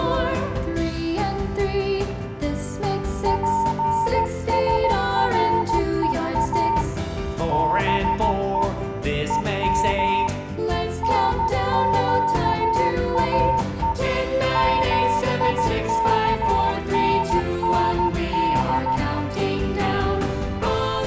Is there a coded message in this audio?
Yes: Morse code (Persian alphabet) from 3.2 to 19.0 s, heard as a keyed tone, hand-sent with a paddle, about 14 wpm, 910 Hz. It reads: پسرها به هم نگاه میکنند